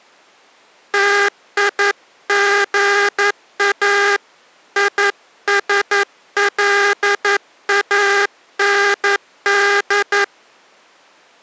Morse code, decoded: TIGA ISLAND

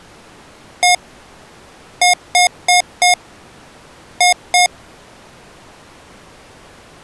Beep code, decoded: 1-4-2

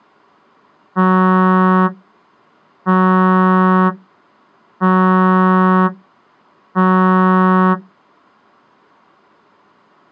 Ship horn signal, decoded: 4 short

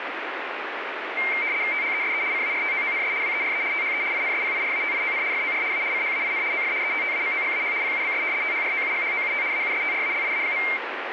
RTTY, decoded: THESE CARTOONS WERE THE INSPIRATION FOR A CHAIN OF ETTAMOGAH PUBS THROUGHOUT AUSTRALIA.

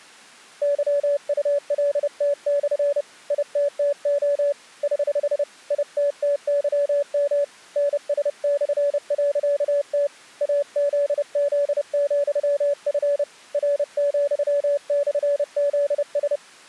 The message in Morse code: YULT/ ITTO <HH> ITTYM NS/.T AZZ,F R,/ZS

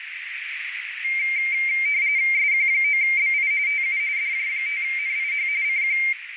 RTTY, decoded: SQ9BI TU DJ5NIH CQ

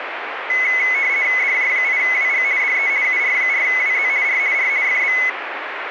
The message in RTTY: DJ8WG DE UR4WZ R R FB

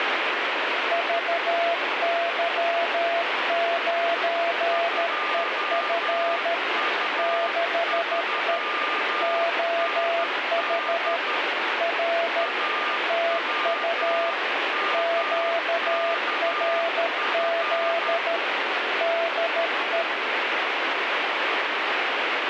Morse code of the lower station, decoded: VY9EF 6E OH R TU QRZ DE

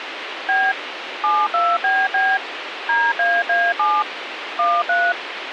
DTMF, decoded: B 72BB DAA7 13

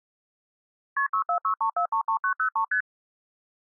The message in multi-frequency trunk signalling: KP 6463433903 ST

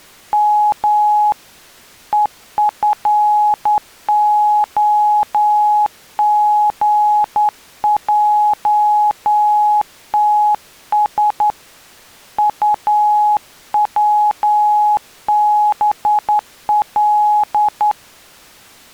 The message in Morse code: M EFOGJTS UWBL

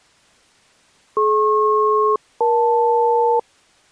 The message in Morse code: none

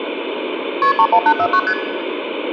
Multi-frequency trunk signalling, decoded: KP 31849 ST

